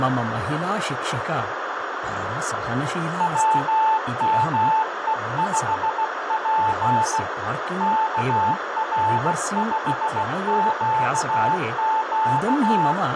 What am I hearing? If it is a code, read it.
Morse code, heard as a keyed tone, hand-sent with a bug key, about 16 wpm, 880 Hz, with radio static, a narrow filter, room echo and speech in Sanskrit. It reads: WME5P KR5QQ